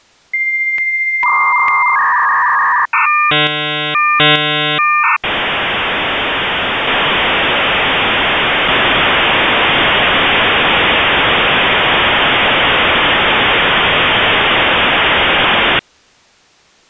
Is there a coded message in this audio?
Yes: dial-up modem handshake (V.34 or later) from 0.3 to 15.8 s, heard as a whistle, warbles, then hiss.